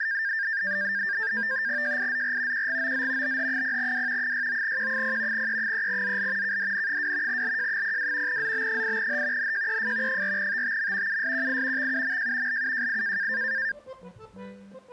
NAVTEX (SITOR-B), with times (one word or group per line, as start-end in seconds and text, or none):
1.8-2.7 JIZR
2.5-3.4 QGOZ
3.2-4.3 BH0W
4.2-5.5 69Q0
5.3-6.6 E3ZL
6.4-7.4 KDN2
7.3-8.4 LJ02
8.3-9.5 ZB8H
9.4-10.2 NJEF
10.1-11.2 4TTM
11.1-11.9 USQI
11.8-12.6 XUMJ
12.5-13.3 LUJI